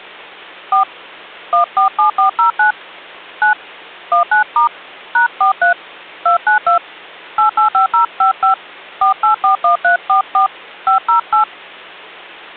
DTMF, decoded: 4 147409 9 19* #43 292 885055 4841344 508

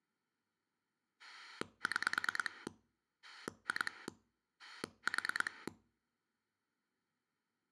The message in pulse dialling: 6 2 4

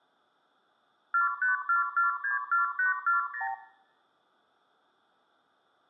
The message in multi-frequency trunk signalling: 454464840

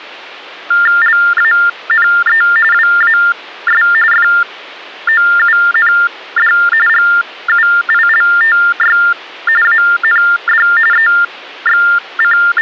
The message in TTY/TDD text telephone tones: LANE WAS FOUND GUILTY AND …

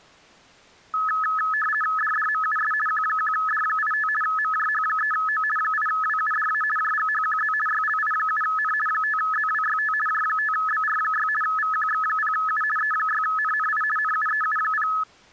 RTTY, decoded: DDMUS Q1D85 MJH3O 8WUDA JGHQZ YLI7N 5ZWYT J5BR6 VQX0U E6NNI NUEU0

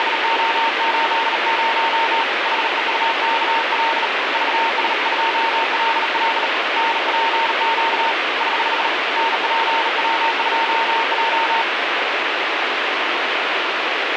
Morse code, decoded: … HEUKL VS2LL NPQ <HH> NPW2J

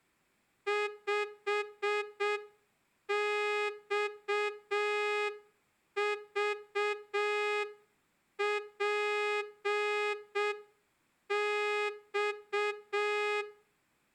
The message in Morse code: 5XVPX

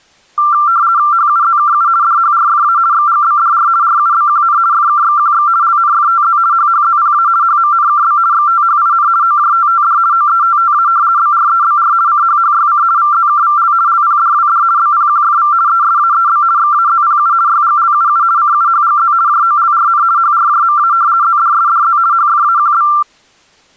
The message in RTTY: HUZKU DHRFA XGBDR RUBQN FKXQX LNFTZ HHZPA HMNKB XTHIN OJTTD OETTA BREBR CHHYC VZKVL LPDWD BPQFV ESAEB XAZPU YGLUU CUHGZ JOLRN HRJMA ZDSDZ HFAQB

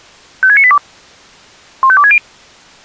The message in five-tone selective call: 56982 15260

